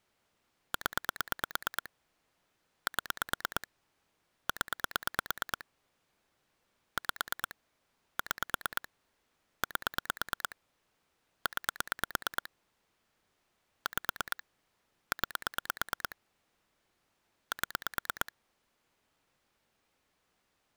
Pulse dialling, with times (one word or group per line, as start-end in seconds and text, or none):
0.7-1.9 0
2.9-3.7 7
4.5-5.7 0
7.0-7.6 5
8.2-8.9 6
9.6-10.6 8
11.5-12.5 9
13.9-14.4 5
15.1-16.2 9
17.5-18.3 7